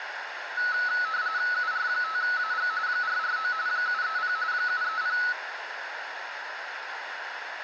RTTY (45.45 baud, 170 Hz shift), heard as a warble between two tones, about 1380 Hz centre, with radio static and a narrow filter. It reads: UR5AG 449 730 730